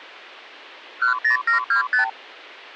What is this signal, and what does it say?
Multi-frequency trunk signalling (R2, with the far end's replies), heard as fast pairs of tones, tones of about 110 ms. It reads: 10725